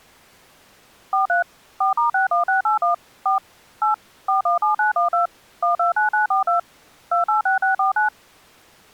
DTMF, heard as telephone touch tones, dialled by machine, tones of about 130 ms. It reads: 43 4*61681 4 8 417912 129942 286649